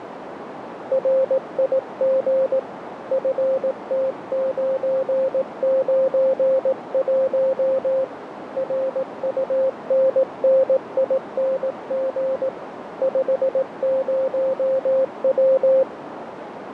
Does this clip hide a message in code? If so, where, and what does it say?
Yes: Morse code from 0.9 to 15.9 s, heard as a keyed tone, hand-sent with a paddle, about 18 wpm, 530 Hz, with radio static and a narrow filter. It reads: RIG FT991 RUNNING 50W